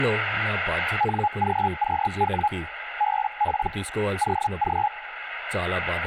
Hellschreiber (Feld-Hell, 122.5 baud), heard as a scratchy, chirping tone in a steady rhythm, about 840 Hz, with radio static and speech in Telugu. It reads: NGQW BP OG